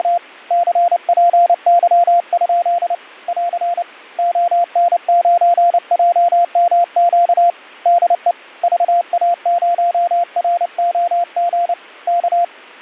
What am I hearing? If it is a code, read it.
Morse code, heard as a keyed tone, hand-sent with a paddle, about 29 wpm, 690 Hz. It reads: … CPY? <AR> ON9JMQ DE VA0ROG K